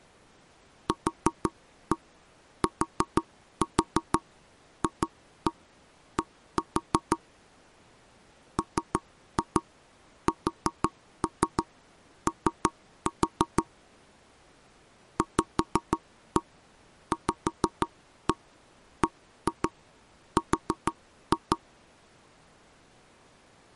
Tap code, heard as knocks on wood, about 6 knocks a second. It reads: QTFD MSO VVBR